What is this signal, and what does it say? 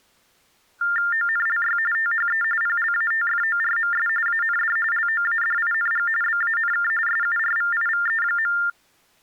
TTY/TDD text telephone tones (45.45 baud Baudot), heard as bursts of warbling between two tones, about 400 Hz shift, 1600 Hz centre. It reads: ONLY THE PLATFORMS AND LOADING BANK SURVIVE.